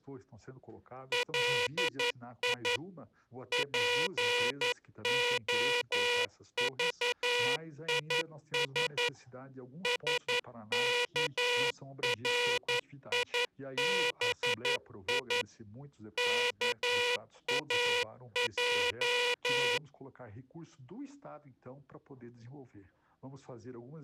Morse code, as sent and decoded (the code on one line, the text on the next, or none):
.-.. .. / .--. --- ...- .. ... / ... -.- .-. .. -... .. / -.- .- .---
LI POVIS SKRIBI KAJ